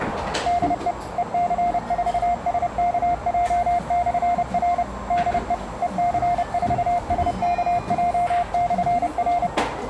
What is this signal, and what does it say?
Morse code, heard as a keyed tone, machine-sent, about 30 wpm, 700 Hz, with radio static, a narrow filter and the noise of a cafe. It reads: DE EC4SKJ/R DE EC4SKJ/R